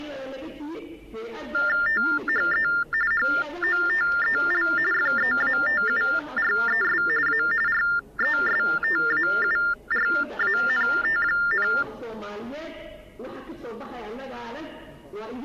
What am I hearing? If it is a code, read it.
TTY/TDD text telephone tones (45.45 baud Baudot), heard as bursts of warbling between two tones, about 400 Hz shift, 1600 Hz centre. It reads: THE HOTEL FEATURES A RESTAURANT,